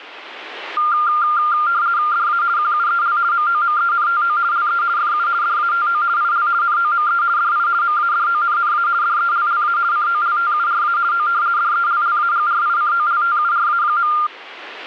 RTTY (50 baud, 170 Hz shift), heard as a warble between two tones, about 1300 Hz centre. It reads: DA QUEL MOMENTO LE FU DATO IL NOME DI MADONNA DELLA COLTURA O DELLAGRICOLTURA.